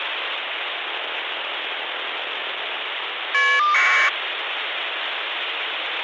Caller ID data burst, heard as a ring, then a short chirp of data, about 1200 baud, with phone line noise.